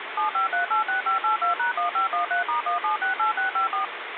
DTMF, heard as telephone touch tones, dialled by machine, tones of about 120 ms, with phone line noise. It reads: 75386582#1513*1768654